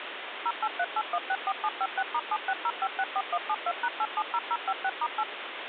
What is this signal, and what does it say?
DTMF, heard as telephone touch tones, dialled by machine, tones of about 50 ms, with phone line noise. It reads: 0838164756*760564172#870056*8